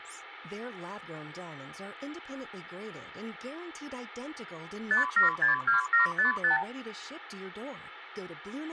Multi-frequency trunk signalling (R2, with the far end's replies), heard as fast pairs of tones, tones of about 130 ms, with phone line noise and speech in English. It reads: 5762755